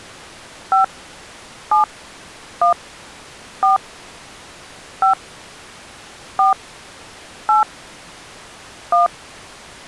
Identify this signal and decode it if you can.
DTMF, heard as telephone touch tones, dialled by hand, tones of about 120 ms. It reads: 5 7 1 4 5 4 8 1